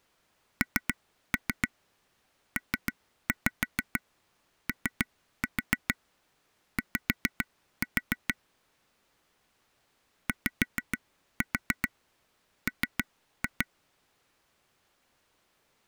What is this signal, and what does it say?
Tap code, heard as taps on a table, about 6 knocks a second. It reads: NPOY YM